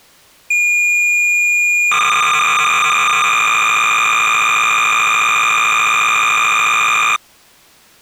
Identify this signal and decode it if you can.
Cassette data (Kansas City type), 300 baud, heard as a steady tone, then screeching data.